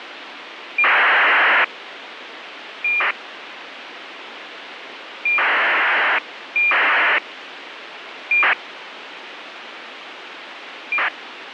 ACARS aircraft data, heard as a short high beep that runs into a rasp, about 2400 baud, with radio hiss.